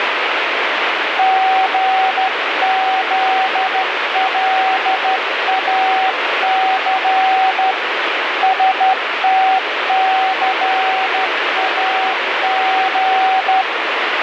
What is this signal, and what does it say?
Morse code, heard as a keyed tone, hand-sent with a straight key, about 13 wpm, 760 Hz, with heavy radio static. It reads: GZLAC STCAG